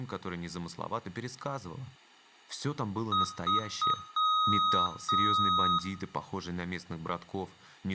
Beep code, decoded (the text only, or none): 3 short, 2 long